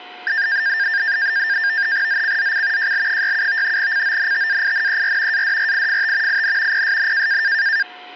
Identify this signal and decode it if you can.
NAVTEX (SITOR-B), 100 baud, 170 Hz shift, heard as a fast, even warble, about 1700 Hz centre, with a steady whistle near 720 Hz. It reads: ZCZC JL67 CONTAINER ADRIFT IN PSN